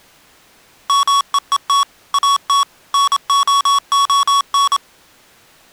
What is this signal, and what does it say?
Morse code, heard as electronic beeps, machine-sent, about 27 wpm, 1120 Hz. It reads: MEET AT NOON